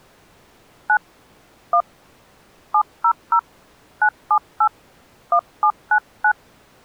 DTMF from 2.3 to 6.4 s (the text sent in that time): 700 978 1799